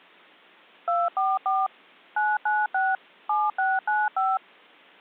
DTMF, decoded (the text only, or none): 244 996 7695